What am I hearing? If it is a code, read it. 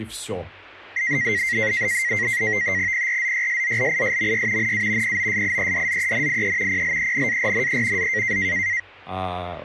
NAVTEX (SITOR-B), 100 baud, 170 Hz shift, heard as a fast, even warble, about 2000 Hz centre, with speech in Russian. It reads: PRZYSZLISMY NA POSIEDZENIE PLENARNE Z